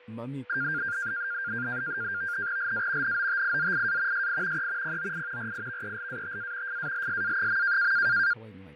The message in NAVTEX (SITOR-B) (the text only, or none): LA NOTIZIA SI E POI RIVELATA FALSA.